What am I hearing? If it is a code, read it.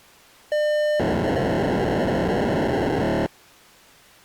POCSAG pager data (1200 baud), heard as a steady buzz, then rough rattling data.